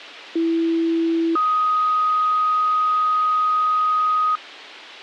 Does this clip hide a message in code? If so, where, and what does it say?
Yes: two-tone page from 0.4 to 4.4 s, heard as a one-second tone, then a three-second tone, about 330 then 1250 Hz.